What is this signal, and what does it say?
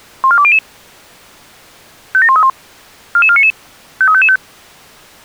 Five-tone selective call (ZVEI), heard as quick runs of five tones, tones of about 70 ms. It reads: 14200 57131 44499 53555